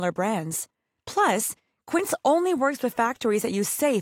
Speech in English. There is no code.